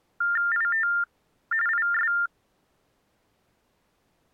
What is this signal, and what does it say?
TTY/TDD text telephone tones (45.45 baud Baudot), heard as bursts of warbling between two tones, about 400 Hz shift, 1600 Hz centre. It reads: IT IS